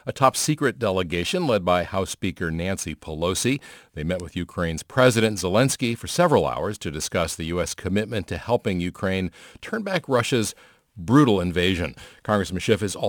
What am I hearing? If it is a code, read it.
Speech in English. There is no code.